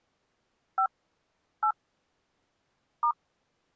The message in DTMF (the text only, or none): 5 8 *